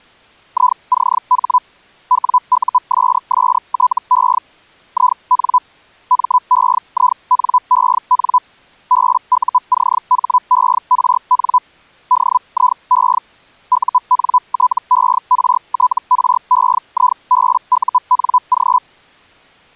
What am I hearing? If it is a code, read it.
Hellschreiber (Feld-Hell, 122.5 baud), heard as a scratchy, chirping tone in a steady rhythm, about 1000 Hz. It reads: ICH WUSSTE IN MEINEN BUCHERN DIE UNTERTREIBUNG